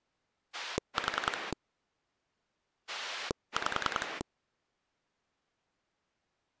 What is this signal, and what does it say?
Pulse dialling, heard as a rotary dial, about 10 pulses a second. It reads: 4 5